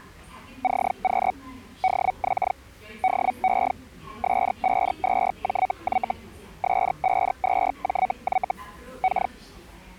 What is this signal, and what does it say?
Hellschreiber (Feld-Hell, 122.5 baud), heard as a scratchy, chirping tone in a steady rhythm, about 750 Hz, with the noise of a subway station. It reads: CQ DX DE S52JY S52JY K